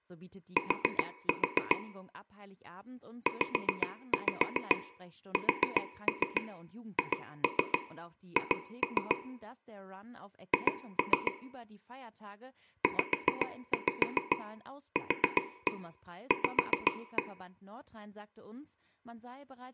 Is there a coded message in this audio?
Yes: tap code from 0.6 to 17.2 s, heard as taps on a table, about 7 knocks a second, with room echo and speech in German. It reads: T ZSHH H ZQV